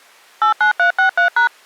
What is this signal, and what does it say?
DTMF, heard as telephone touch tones, dialled by machine, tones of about 110 ms. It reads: 89363#